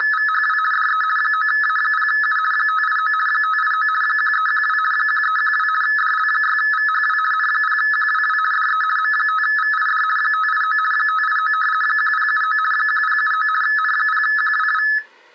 RTTY (50 baud, 450 Hz shift), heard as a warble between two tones, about 1500 Hz centre. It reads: … DE 9A0U 589 589 1312 1312 DL6VHW N0QWW DE M5VID 589 589 1079 1079 N0QWW